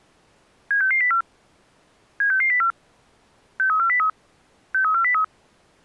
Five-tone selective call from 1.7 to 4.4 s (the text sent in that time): 76604 63403